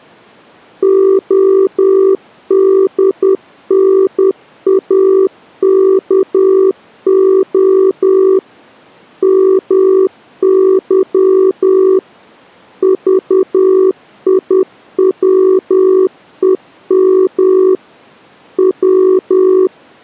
Morse code (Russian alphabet), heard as a keyed tone, machine-sent, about 10 wpm, 380 Hz. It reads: ОДНАКО МЫ ЖИВЕМ В